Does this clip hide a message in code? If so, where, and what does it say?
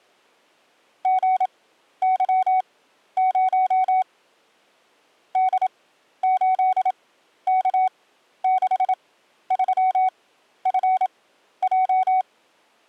Yes: Morse code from 1.0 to 12.3 s, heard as a keyed tone, machine-sent, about 27 wpm, spaced as for 12 wpm, 750 Hz. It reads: GY0 D8K63FJ